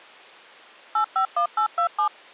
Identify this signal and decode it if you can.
DTMF, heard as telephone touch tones, dialled by machine, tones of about 100 ms. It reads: 851827